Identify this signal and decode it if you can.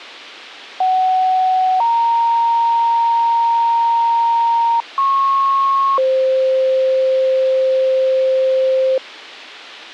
Two-tone page, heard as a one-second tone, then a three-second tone, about 750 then 930 Hz, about 1090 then 520 Hz.